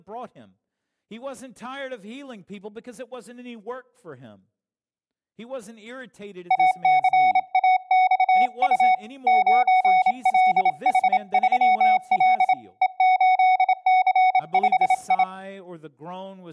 Morse code, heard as a keyed tone, hand-sent with a bug key, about 27 wpm, 740 Hz, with speech in English. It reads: ACAXU 9LH3L E8C5I